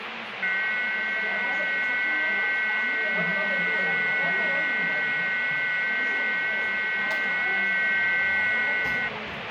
FT8 (several signals at once), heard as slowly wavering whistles, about 6.25 baud, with radio static and the noise of a crowd indoors.